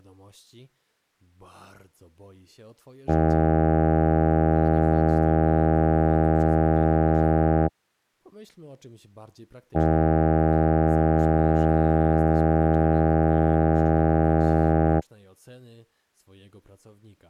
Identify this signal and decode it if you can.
Ship horn signal, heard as a ship's horn, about 80 Hz, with speech in Polish. 2 long. At sea: a vessel under power that has stopped in fog.